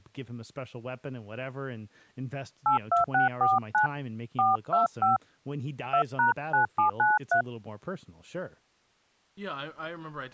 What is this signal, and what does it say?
DTMF, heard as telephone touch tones, dialled by hand, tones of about 130 ms, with speech in English. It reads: 82649 425 2#9793